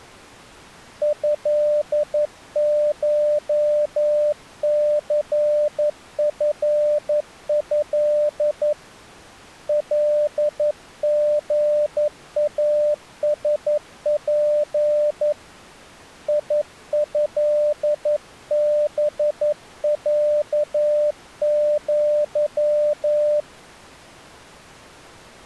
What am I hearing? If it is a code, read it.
Morse code (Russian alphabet), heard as a keyed tone, hand-sent with a paddle, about 11 wpm, 600 Hz. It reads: ЭШЦФЭ ЛГАСП ИЭБЯЪ